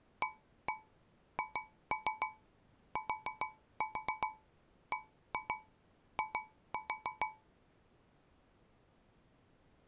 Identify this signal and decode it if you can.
Tap code, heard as taps on a metal pipe, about 6 knocks a second. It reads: AHTBI